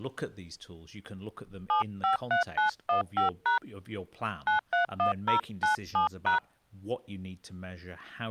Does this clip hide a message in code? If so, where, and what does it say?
Yes: DTMF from 1.7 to 6.4 s, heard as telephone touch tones, dialled by hand, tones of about 120 ms, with speech in English. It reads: 753915# 931097#